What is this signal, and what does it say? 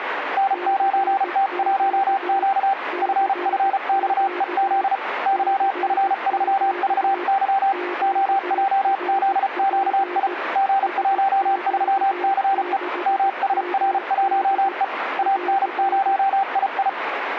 Morse code, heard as two keyed tones, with radio static. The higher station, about 34 wpm, 780 Hz: N9T1Q FFXEZ YF3VY OJZQI G13CE MSR1E AN0II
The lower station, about 17 wpm, 360 Hz: CQ CQ CQ QRP SQ6MD <AR>